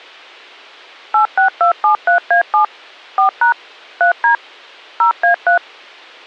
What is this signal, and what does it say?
DTMF, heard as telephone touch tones, dialled by machine, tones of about 110 ms. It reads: 86273A7 4# 3D 0A3